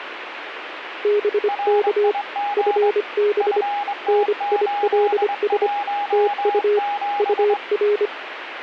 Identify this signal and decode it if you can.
Morse code, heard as two keyed tones, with radio static. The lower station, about 25 wpm, 420 Hz: BK FB NILS TU UR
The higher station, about 22 wpm, 820 Hz: RIG FT817